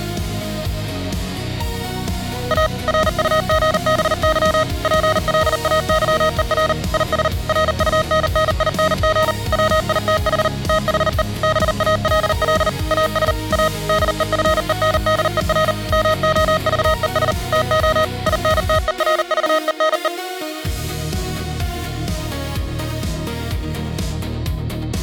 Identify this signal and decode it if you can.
Morse code, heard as electronic beeps, machine-sent, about 39 wpm, 630 Hz. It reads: A RUGBY PLAYER IS RUNNING WITH THE BALL AS A DEFENDER MOVES TO INTERVENE